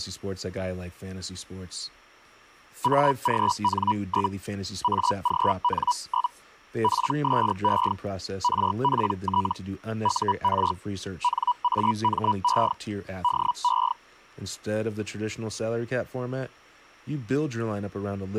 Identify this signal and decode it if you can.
Hellschreiber (Feld-Hell, 122.5 baud), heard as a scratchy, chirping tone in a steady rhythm, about 980 Hz, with speech in English. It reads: AGN? AGN? PSE RPT UR NAME DE